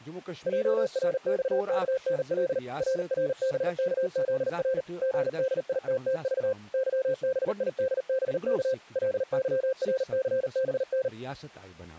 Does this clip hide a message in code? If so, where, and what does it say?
Yes: Morse code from 0.4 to 11.1 s, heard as a keyed tone, machine-sent, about 39 wpm, 520 Hz, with speech in Kashmiri. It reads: JRXKNL RRBKZR GDITTV YBIDBK LYRCBN